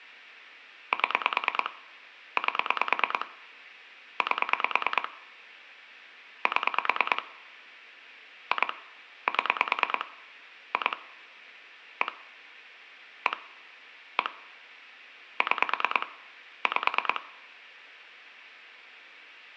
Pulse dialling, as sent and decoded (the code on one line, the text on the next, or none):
7 / 8 / 8 / 7 / 2 / 7 / 2 / 1 / 1 / 1 / 6 / 5
7 8 8 7 2 7 2 1 1 1 6 5